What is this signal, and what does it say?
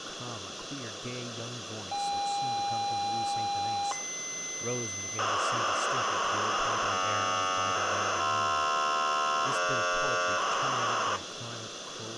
ZX Spectrum tape loading, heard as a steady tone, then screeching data, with tape hiss and speech in English.